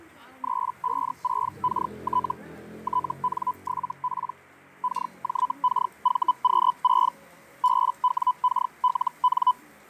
Hellschreiber (Feld-Hell, 122.5 baud), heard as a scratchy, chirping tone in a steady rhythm, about 1000 Hz, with fading and the noise of a restaurant. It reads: 356KT TN7P KJKVQ6 BWKLN